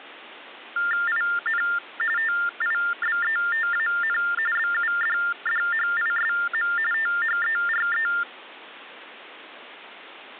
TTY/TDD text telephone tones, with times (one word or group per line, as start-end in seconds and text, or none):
1.1-1.6 IN
2.2-4.2 TIBETAN
4.6-6.7 BUDDHISM
6.9-8.1 THERE